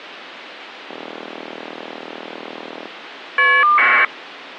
Caller ID data burst, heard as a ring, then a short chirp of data, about 1200 baud.